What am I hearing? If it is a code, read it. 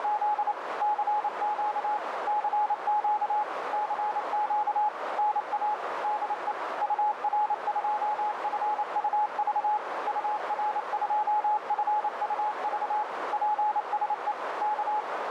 Morse code, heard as a keyed tone, machine-sent, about 28 wpm, 840 Hz, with radio static and a narrow filter. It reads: … CQ CQ CQ NA DE UR2FUV UR2FUV PSE K